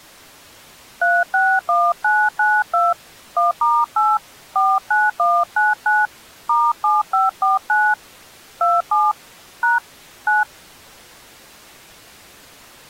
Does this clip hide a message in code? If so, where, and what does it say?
Yes: DTMF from 1.0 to 10.4 s, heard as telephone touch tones, dialled by hand, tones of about 200 ms. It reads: 361992 1*8 49199 *7549 27 # 9